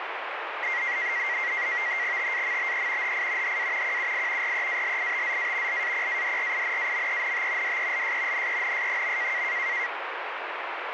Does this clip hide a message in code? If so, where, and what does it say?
Yes: NAVTEX (SITOR-B), 100 baud, 170 Hz shift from 0.6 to 9.9 s, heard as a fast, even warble, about 2000 Hz centre, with radio static. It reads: TAMBE HI HA QUI REALITZA LAPADRINAMENT DELS NENS.